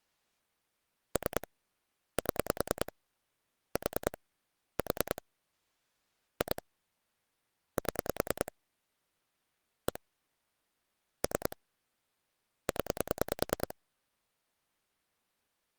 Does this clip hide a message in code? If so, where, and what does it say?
Yes: pulse dialling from 1.2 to 13.7 s, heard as clicks on a phone line, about 10 pulses a second. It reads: 3 7 4 4 2 7 1 3 0